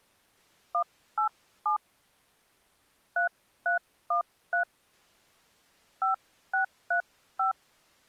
DTMF, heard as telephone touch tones, dialled by hand, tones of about 110 ms. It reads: 187 3313 5635